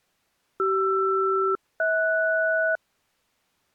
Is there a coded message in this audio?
Yes: aircraft SELCAL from 0.6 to 2.8 s, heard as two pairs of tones. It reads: CR-HS